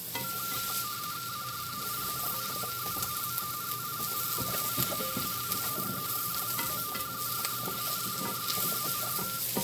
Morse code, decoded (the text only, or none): none